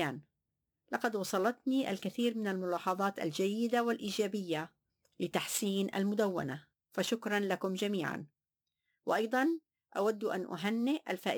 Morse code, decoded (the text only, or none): none